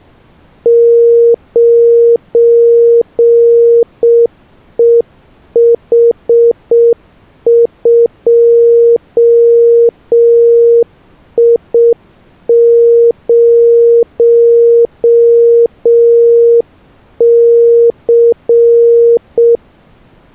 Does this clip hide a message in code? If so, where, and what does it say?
Yes: Morse code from 0.6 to 19.6 s, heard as a keyed tone, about 6 wpm, 470 Hz. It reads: 9EH2I0C